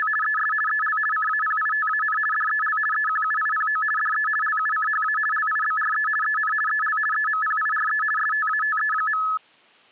RTTY (50 baud, 450 Hz shift), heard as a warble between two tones, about 1500 Hz centre. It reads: … ES EL CAPITAN DEL EQUIPO DE LUCHA LIBRE EN EL EMPIRE STATE.